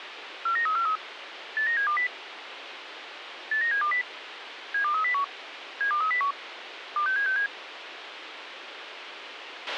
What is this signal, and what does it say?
Five-tone selective call (CCIR), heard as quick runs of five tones, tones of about 100 ms, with radio hiss and a squelch burst at the end. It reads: 49343 89720 89720 72301 72301 26767